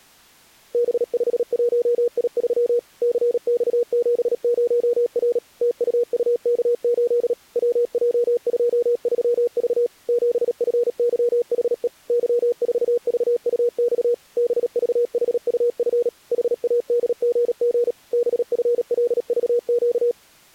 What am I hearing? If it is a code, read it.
Morse code, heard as a keyed tone, machine-sent, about 37 wpm, 480 Hz. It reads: B51I3 CX70R TUUK8 WJ23V 7FYHE Y4VUX BVHUF HADGG BFLVQ